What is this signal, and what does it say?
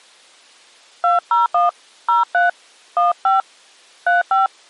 DTMF, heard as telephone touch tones, dialled by hand, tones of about 150 ms. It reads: 201 03 15 35